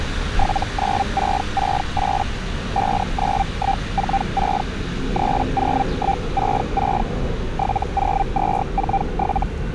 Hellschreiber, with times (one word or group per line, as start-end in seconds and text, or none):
0.4-2.2 79668
2.8-4.6 59146
5.2-7.0 30166
7.6-9.4 70247